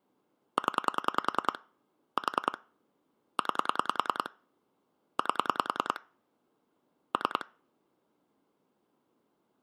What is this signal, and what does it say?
Pulse dialling, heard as clicks on a phone line, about 10 pulses a second. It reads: 0 4 9 8 3